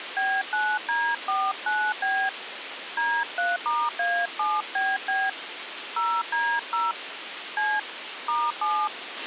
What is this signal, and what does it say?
DTMF, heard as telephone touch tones, dialled by hand, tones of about 230 ms, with radio hiss and a squelch burst at the end. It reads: B9D49B D3*A7BB 0D0 C *7